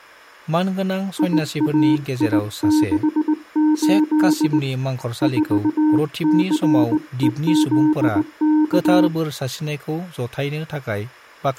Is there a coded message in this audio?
Yes: Morse code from 1.1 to 9.1 s, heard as a keyed tone, hand-sent with a straight key, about 18 wpm, 310 Hz, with speech in Bodo. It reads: IAI68 4CEZK